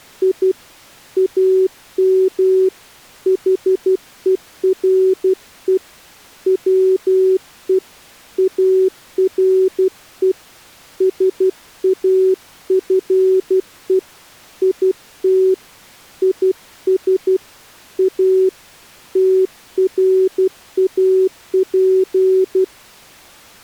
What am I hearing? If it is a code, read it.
Morse code, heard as a keyed tone, hand-sent with a paddle, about 12 wpm, 380 Hz. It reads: I AM HERE WE ARE SAFE IT IS A TRAP